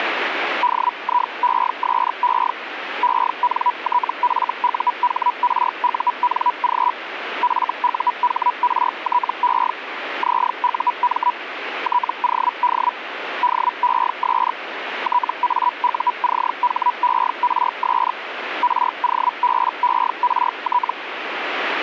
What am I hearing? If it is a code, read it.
Hellschreiber (Feld-Hell, 122.5 baud), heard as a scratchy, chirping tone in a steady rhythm, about 980 Hz, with radio static. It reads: DIESE ENTFUHRUNG FUHRTE ZUM TOD DES TAUCHERS ROBERT